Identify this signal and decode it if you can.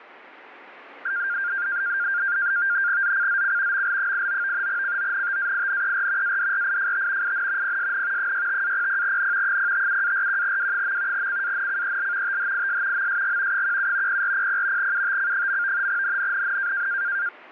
NAVTEX (SITOR-B), 100 baud, 170 Hz shift, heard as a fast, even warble, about 1500 Hz centre. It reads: ZCZC ML89 CONTAINER ADRIFT IN PSN 65-00N 057-41W. CANCEL THIS MSG 17 0400 UTC. NNNN